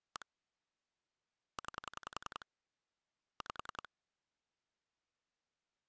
Pulse dialling, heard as clicks on a phone line, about 10 pulses a second. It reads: 1 9 5